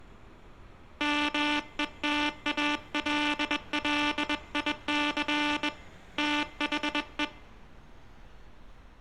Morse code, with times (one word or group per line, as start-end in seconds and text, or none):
1.0-5.7 METALLIC
6.2-7.2 THE